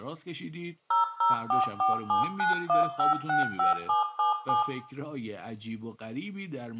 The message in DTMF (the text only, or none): 0044791565777